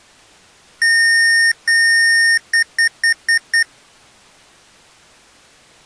Beep code, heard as beeps from a small speaker, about 1850 Hz. 2 long, 5 short.